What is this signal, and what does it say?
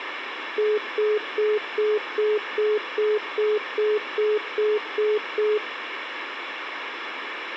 Telephone call progress tone (single-tone plan, as in most of Europe), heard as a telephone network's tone, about 420 Hz, 0.2 s on and 0.2 s off, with phone line noise. Congestion tone.